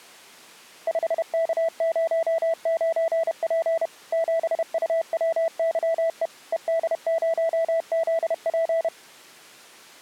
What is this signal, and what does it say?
Morse code, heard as a keyed tone, machine-sent, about 31 wpm, 660 Hz. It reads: 5K09P 7UWYE ED0ZP